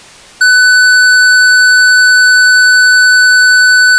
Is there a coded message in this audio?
No, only a steady tone.